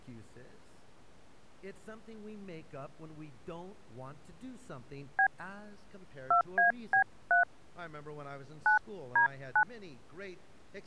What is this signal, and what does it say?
DTMF, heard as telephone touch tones, dialled by hand, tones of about 90 ms. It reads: B 2AB3 9D9